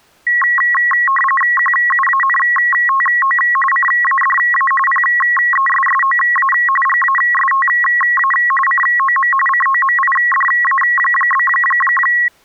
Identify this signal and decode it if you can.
RTTY (45.45 baud, 850 Hz shift), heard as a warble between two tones, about 1500 Hz centre. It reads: QUANTO CADA PESSOA GASTA COM COMIDA?